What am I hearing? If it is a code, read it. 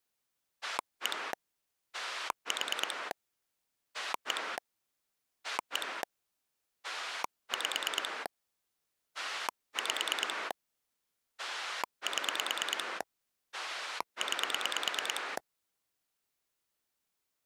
Pulse dialling, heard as a rotary dial, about 9 pulses a second. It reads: 1 4 1 1 5 5 7 9